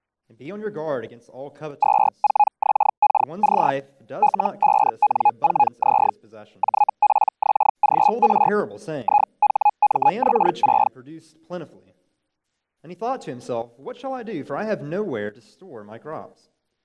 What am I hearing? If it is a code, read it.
Hellschreiber (Feld-Hell, 122.5 baud), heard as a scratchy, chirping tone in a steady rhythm, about 830 Hz. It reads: 24XKC L5N4Z JPXGR IHMX6